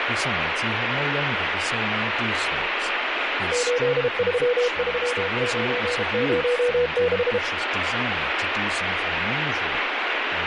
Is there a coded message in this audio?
Yes: Morse code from 3.5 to 7.4 s, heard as a keyed tone, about 32 wpm, 490 Hz, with heavy radio static and speech in English. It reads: 833906